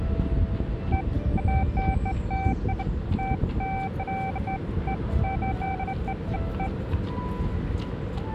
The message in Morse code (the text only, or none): none